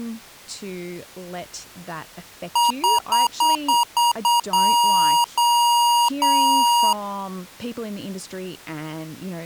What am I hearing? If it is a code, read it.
Beep code, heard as beeps from a small speaker, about 950 Hz, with speech in English. 7 short, 3 long.